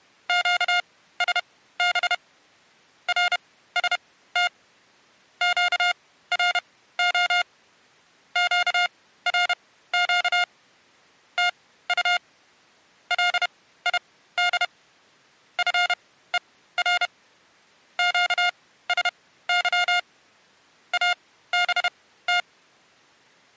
Morse code, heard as electronic beeps, machine-sent, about 31 wpm, spaced as for 16 wpm, 710 Hz. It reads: QSB RST QRO QRQ TU LID FER QSY ABT